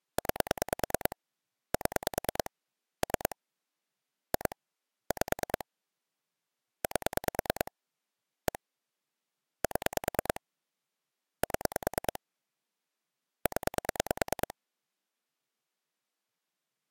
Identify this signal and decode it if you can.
Pulse dialling, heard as clicks on a phone line, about 9 pulses a second. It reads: 9 7 3 2 5 8 1 7 7 0